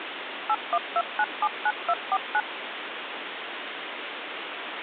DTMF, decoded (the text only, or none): 812979249